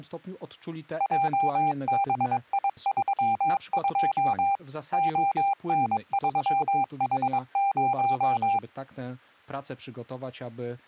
Morse code, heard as a keyed tone, machine-sent, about 22 wpm, 790 Hz. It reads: JBI32 ON3H0